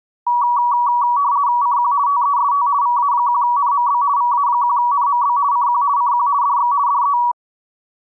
RTTY (50 baud, 170 Hz shift), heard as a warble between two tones, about 1050 Hz centre. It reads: CQ TEST VA1NMB VA1NMB CQ CQ DX DE